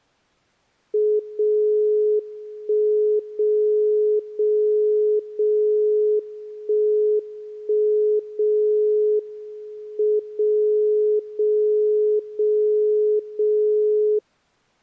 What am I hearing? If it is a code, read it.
Radio time signal (WWVB), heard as a tone whose level steps once a second, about 420 Hz. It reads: 0 1 0 0 0 1 1 0 M 0 0 0 0